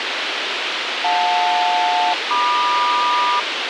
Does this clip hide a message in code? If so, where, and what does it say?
Yes: aircraft SELCAL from 1.0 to 3.4 s, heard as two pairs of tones, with radio hiss and a squelch burst at the end. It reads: JL-MQ